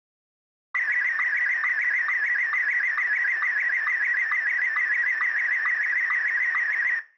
SSTV (slow-scan television), Martin M1, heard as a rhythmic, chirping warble, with room echo.